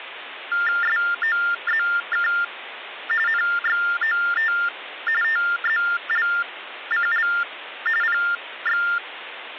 TTY/TDD text telephone tones (45.45 baud Baudot), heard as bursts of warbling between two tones, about 400 Hz shift, 1600 Hz centre, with phone line noise. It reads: SOZK NXOT TZLCL PX